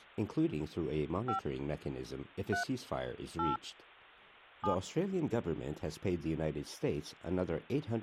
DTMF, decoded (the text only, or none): 5 3 8 7